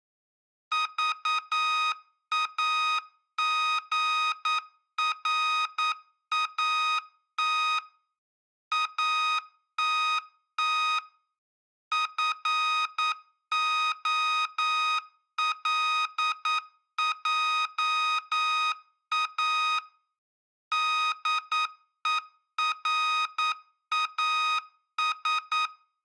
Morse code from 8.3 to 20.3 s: ATT FOLJA

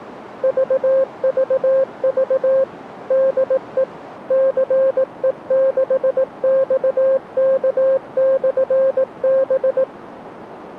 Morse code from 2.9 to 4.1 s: DE

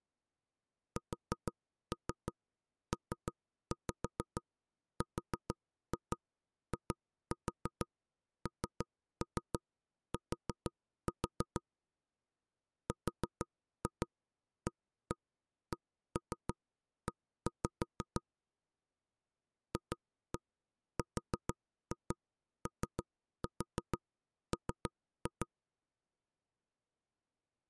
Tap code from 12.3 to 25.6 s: RACE FROM

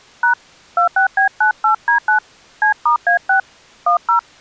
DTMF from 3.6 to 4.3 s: 10

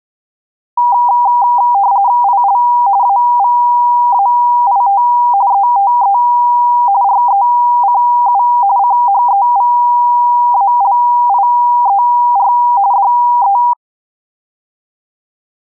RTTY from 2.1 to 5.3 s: IL AVAIT

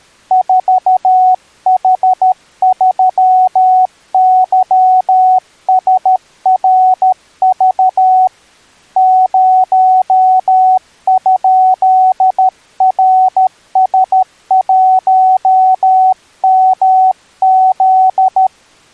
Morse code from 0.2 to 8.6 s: 4H3YSRV

